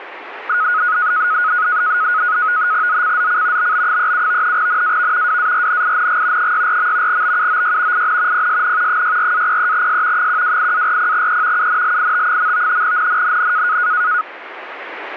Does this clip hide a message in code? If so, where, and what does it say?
Yes: NAVTEX (SITOR-B), 100 baud, 170 Hz shift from 0.5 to 14.2 s, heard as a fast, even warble, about 1360 Hz centre, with radio static. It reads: ZCZC BB37 NAV WARNING 64. BUOY IN PSN 64-03S 128-40E UNLIT. NNNN